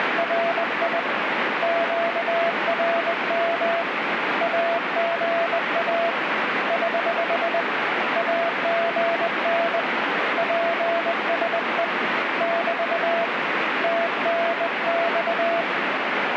Morse code, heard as a keyed tone, hand-sent with a bug key, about 20 wpm, 680 Hz, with radio static. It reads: … QRM AGA <HH> AGN PSE <BT> TNX